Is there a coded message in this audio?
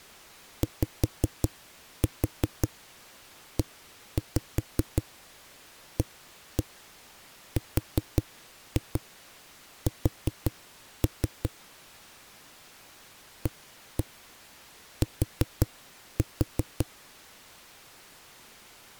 Yes: tap code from 0.6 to 16.9 s, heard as knocks on a wall, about 5 knocks a second. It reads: YEARS AT